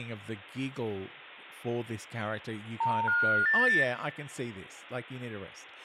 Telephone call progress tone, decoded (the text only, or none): special information tone